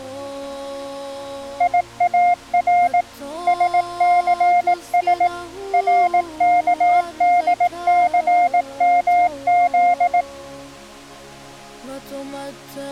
Morse code, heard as a keyed tone, machine-sent, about 18 wpm, 710 Hz. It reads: IAR SCS RKDCMZ